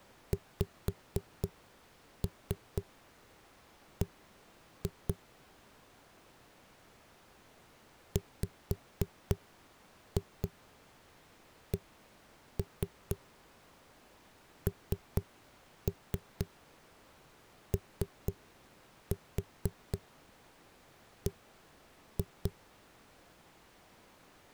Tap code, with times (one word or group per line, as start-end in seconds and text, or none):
0.3-5.1 XB
8.2-22.5 WCNOB